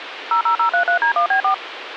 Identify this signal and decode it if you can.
DTMF, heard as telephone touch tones, dialled by machine, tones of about 100 ms, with phone line noise. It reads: 00033D1B4